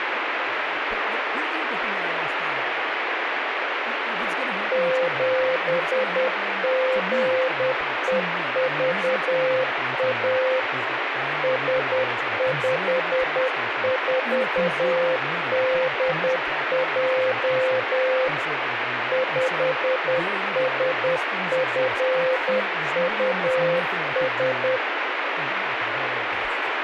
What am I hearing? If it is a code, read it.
Morse code, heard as a keyed tone, machine-sent, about 10 wpm, 520 Hz, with radio static and speech in English. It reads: 7GEVA S54DJ 5SFUS